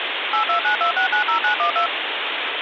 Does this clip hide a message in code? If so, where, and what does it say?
Yes: DTMF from 0.3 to 1.9 s, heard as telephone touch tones, dialled by machine, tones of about 100 ms, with phone line noise. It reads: 8292690912